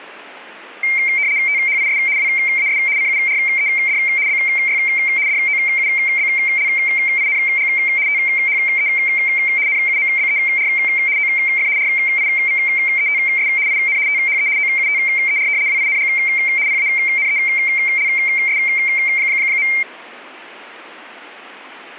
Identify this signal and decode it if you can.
RTTY (75 baud, 170 Hz shift), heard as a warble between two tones, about 2200 Hz centre. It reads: THIS WAS CURED BY DOUBLING THE NUMBER OF RIVETS IN THE OUTER WING PANELS.